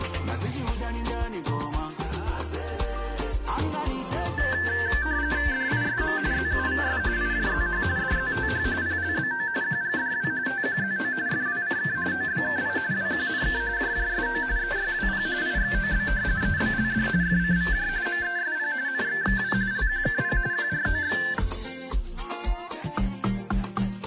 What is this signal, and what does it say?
RTTY (45.45 baud, 170 Hz shift), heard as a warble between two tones, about 1650 Hz centre. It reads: DISM ZUVS IJZH DZTH PLBO QGDW TQZO FWCK OBKI WQNK JJSO EYWP IXOB EBLD FCVJ MESP NXXW LQKP QROX